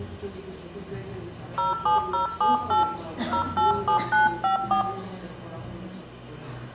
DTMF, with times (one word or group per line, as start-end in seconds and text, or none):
1.6-2.8 07078
3.3-4.8 087954